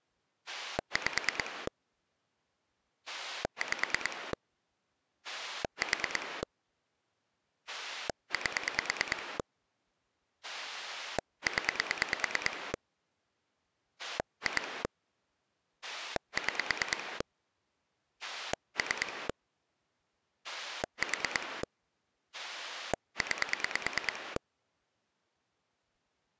Pulse dialling, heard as a rotary dial, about 9 pulses a second. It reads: 5 5 4 8 0 2 6 3 4 9